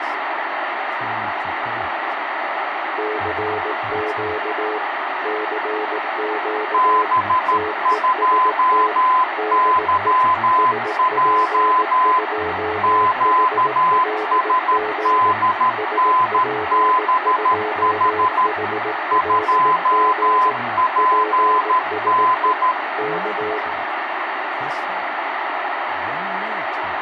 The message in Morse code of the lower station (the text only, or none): CQ CQ TEST DE SP2HLG SP2HLG PSE K